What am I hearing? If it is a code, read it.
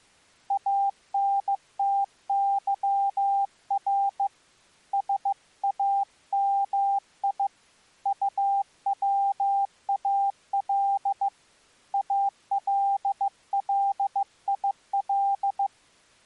Morse code (Arabic alphabet), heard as a keyed tone, hand-sent with a bug key, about 15 wpm, 790 Hz. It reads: انتظر سامي طوال الليل